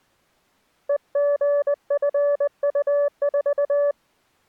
Morse code, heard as a keyed tone, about 20 wpm, 580 Hz. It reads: EGFU4